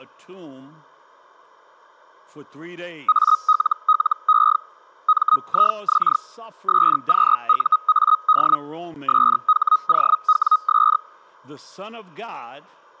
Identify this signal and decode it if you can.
Hellschreiber (Feld-Hell, 122.5 baud), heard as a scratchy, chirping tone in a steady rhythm, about 1260 Hz. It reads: ALLE MIX SQUAD SHOWS